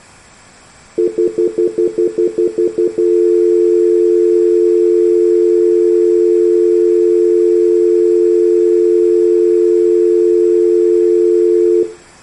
Telephone call progress tone (North American plan), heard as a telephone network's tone, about 350, 440 Hz, 0.1 s on and 0.1 s off. Stutter dial tone.